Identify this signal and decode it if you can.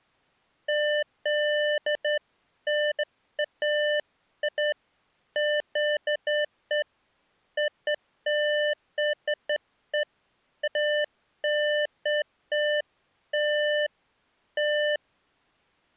Beeps of irregular length. There is no code.